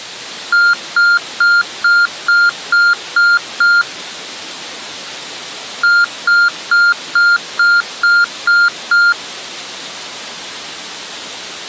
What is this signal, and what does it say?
Beep code, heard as beeps, played twice, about 1400 Hz. 8 short. In AMI BIOS tables: display memory failure; in Dell tables: LCD failure.